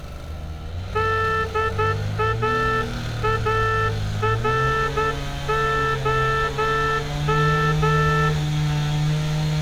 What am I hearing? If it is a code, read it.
Morse code, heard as a horn, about 10 wpm, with street noise. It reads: DAAROM